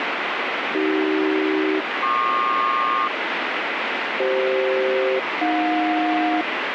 Aircraft SELCAL, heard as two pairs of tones, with radio static. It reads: AC-PQ CF-AJ